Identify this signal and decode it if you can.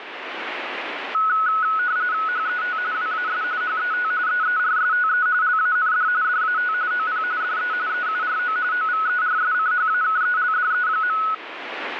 RTTY (45.45 baud, 170 Hz shift), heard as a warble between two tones, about 1380 Hz centre, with radio static. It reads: HET WAS HET EERSTE LAND DAT OP DE EURO OVERSCHAKELDE.